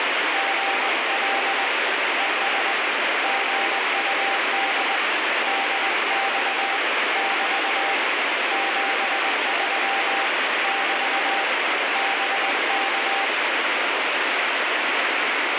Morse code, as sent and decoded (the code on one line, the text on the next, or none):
--. .-.. / . ... / --. ..- -.. / -.. -..- / -...- / --... ...-- / -...- / -... -.-
GL ES GUD DX <BT> 73 <BT> BK